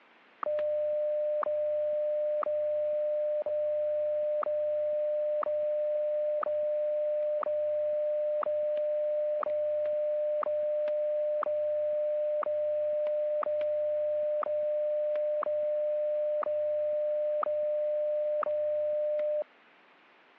Radio time signal (WWVH, Hawaii), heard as ticks, one a second, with static crashes.